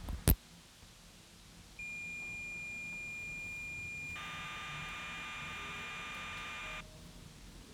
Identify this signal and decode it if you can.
Cassette data (Kansas City type), 1200 baud, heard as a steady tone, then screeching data, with the noise inside a lift.